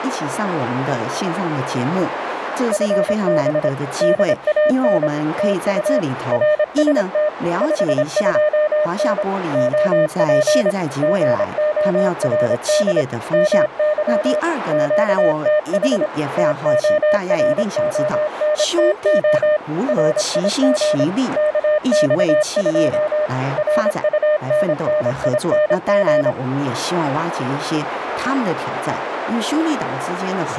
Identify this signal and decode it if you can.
Morse code, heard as a keyed tone, machine-sent, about 26 wpm, 610 Hz, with radio static, a narrow filter and speech in Chinese. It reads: FB DAN TU RST 52N OP GORD MY QTH TORONTO RIG KX2 RUNNING